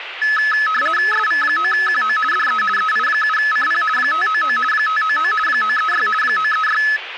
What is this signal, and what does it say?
RTTY (50 baud, 450 Hz shift), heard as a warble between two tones, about 1500 Hz centre, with radio static and speech in Gujarati. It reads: SV9QO DE EI7CP 599 599 936 936